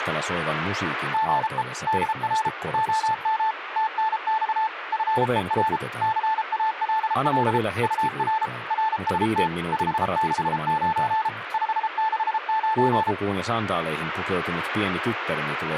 Morse code, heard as a keyed tone, machine-sent, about 33 wpm, 880 Hz, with radio static. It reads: GE DR OM TNX FER CALL UR RST 569 569